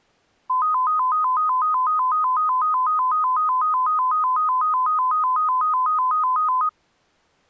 A tone that alternates evenly between two pitches. There is no code.